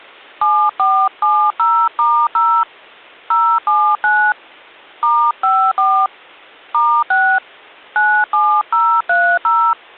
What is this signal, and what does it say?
DTMF, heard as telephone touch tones, dialled by hand, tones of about 280 ms. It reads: 7470*0 079 *54 *6 97030